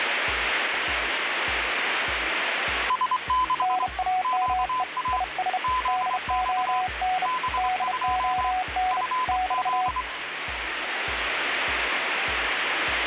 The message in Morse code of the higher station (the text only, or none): S6 QA ZX B2 FZ